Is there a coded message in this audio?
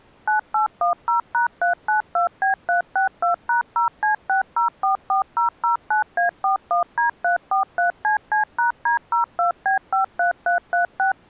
Yes: DTMF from 0.3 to 11.1 s, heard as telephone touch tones, dialled by machine, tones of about 120 ms. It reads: 9810#392B362#0C6044009A41D343CC#D02B53336